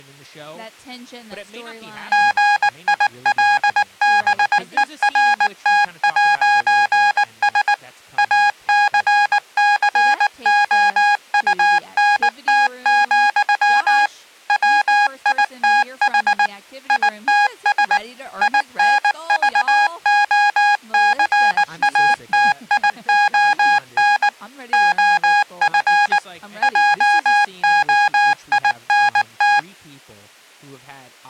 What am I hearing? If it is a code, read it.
Morse code, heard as electronic beeps, machine-sent, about 19 wpm, 820 Hz, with speech in English. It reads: GILBERT'S ACCOUNT, WITH ITS INVOCATION OF JOINT